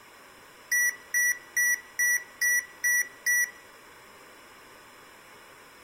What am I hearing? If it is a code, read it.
Beep code, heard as beeps from a small speaker, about 1950 Hz, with room echo. 7 short. In AMI BIOS tables: virtual mode exception error; in Dell tables: processor failure.